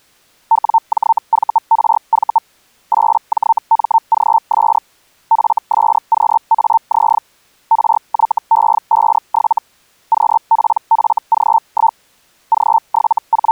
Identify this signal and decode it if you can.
Hellschreiber (Feld-Hell, 122.5 baud), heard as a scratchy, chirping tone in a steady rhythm, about 900 Hz. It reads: WJVRV 8JMGS FSQAZ RYE57 QPFG1 …